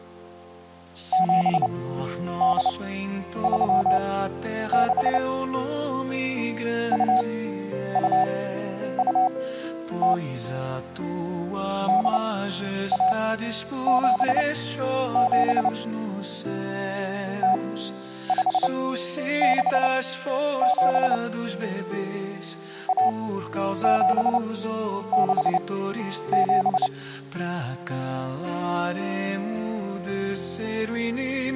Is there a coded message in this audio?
Yes: Morse code (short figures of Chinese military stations) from 1.1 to 26.9 s, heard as a keyed tone, machine-sent, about 29 wpm, spaced as for 10 wpm, 750 Hz. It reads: 7836 2220 8177 0567 1767